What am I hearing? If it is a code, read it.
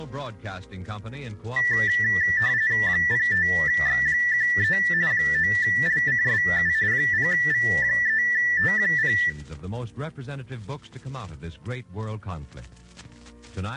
RTTY (45.45 baud, 170 Hz shift), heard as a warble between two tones, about 1850 Hz centre, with room echo. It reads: 05X13 9LCSU 0V3T0